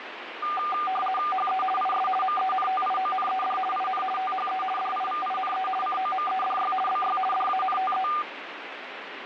RTTY (50 baud, 450 Hz shift), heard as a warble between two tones, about 980 Hz centre, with radio static. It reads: HE IS MENTIONED IN THE DIVINE COMEDY BY DANTE